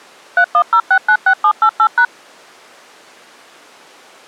DTMF, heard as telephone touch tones, dialled by machine, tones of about 70 ms. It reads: 310696788#